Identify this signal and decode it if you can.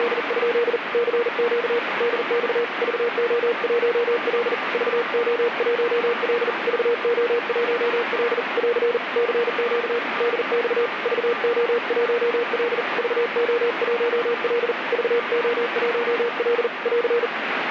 Morse code, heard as a keyed tone, hand-sent with a paddle, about 40 wpm, 470 Hz, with radio static. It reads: … CQ DX VO1L VO1L VO1L <AR> CQ DX VO1L VO1L VO1L <AR>